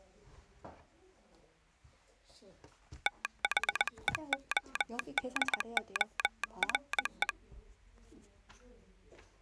Morse code, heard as a telegraph sounder, hand-sent with a paddle, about 20 wpm, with the noise of a crowd indoors. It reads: THEODORE